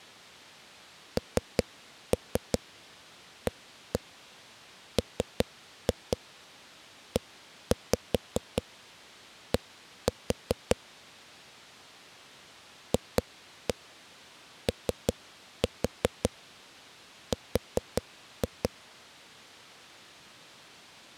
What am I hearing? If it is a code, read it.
Tap code, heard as knocks on a wall, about 5 knocks a second. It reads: NAMED FOR